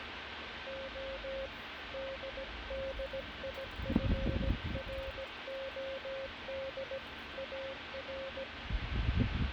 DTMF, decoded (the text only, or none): none